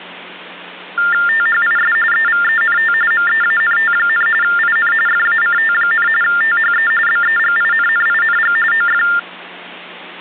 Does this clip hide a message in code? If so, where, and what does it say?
Yes: TTY/TDD text telephone tones (45.45 baud Baudot) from 1.0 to 9.2 s, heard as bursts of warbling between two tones, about 400 Hz shift, 1600 Hz centre, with hum. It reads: THIS EVENT MEANT, IN FACT, THE BEGINNING OF